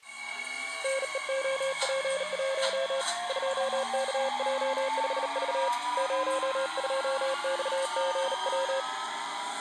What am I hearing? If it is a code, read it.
Morse code, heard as a keyed tone, hand-sent with a bug key, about 38 wpm, 540 Hz, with the noise inside a subway train. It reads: NEOP1 2KJ5V 02XGW